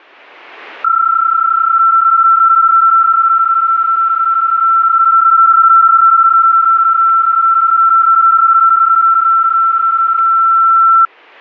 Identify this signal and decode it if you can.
PSK31 (31.25 baud), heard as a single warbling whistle, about 1340 Hz.